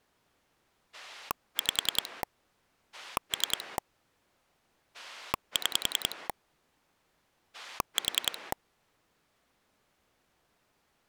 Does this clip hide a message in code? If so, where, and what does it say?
Yes: pulse dialling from 0.9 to 8.5 s, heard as a rotary dial, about 10 pulses a second. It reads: 5 3 6 4